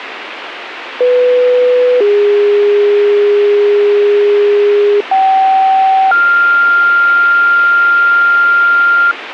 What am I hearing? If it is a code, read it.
Two-tone page, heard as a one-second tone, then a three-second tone, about 500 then 410 Hz, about 770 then 1400 Hz, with radio hiss.